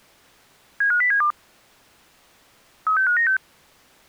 Five-tone selective call (CCIR), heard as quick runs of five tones, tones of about 100 ms. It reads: 75072 36596